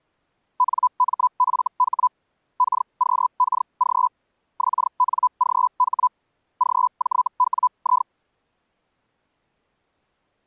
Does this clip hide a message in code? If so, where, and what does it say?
Yes: Hellschreiber (Feld-Hell, 122.5 baud) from 0.6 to 8.1 s, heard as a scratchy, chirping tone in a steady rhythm, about 1000 Hz. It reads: NMFH KQKG XNGH GJWI